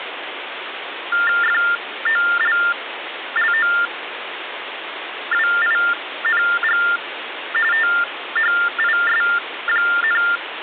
TTY/TDD text telephone tones (45.45 baud Baudot), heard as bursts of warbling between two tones, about 400 Hz shift, 1600 Hz centre, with phone line noise. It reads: FOLLOWING THIS,